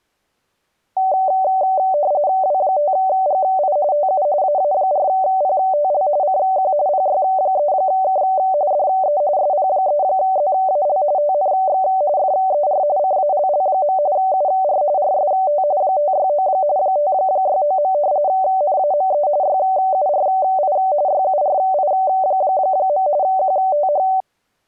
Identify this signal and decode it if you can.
RTTY (45.45 baud, 170 Hz shift), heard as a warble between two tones, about 670 Hz centre. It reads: W5GI TU AA4PTL CQ PY3K DE SP3ZAL TNX FER CALL. UR RST 569 569. NAME YURI YURI. QTH